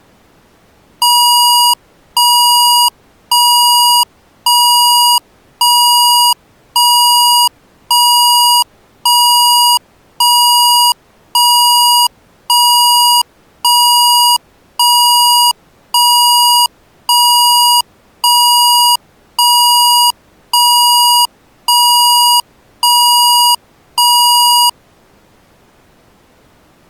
Evenly repeated beeps. There is no code.